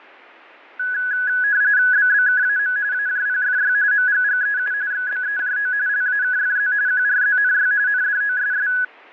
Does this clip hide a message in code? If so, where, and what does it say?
Yes: RTTY (45.45 baud, 170 Hz shift) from 0.8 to 8.8 s, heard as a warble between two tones, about 1600 Hz centre, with static crashes. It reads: BBKAM AJPFY MGGEU XBEJO LAKFZ QRZNY NDOSS